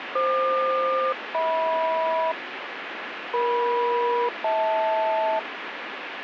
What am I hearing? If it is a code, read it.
Aircraft SELCAL, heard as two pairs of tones, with radio static. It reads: FQ-HM EM-HL